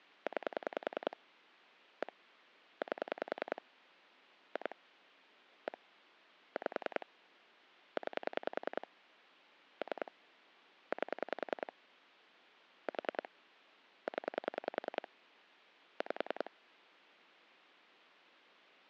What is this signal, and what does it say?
Pulse dialling, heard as clicks on a phone line, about 10 pulses a second. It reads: 9 1 8 2 1 5 9 3 8 4 0 5